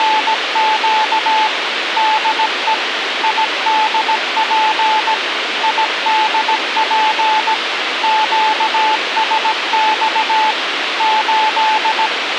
Morse code, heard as a keyed tone, machine-sent, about 17 wpm, 870 Hz, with radio hiss and a squelch burst at the end. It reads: … DE IDP IDP QSX 8